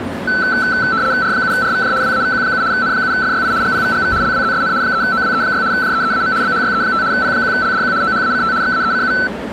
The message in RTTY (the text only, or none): R7RVJ WAVQ7 N7FYI GPVGV LWZSN 3OWE6 JEEAM BHYE5 P1LDQ OHACT XAECU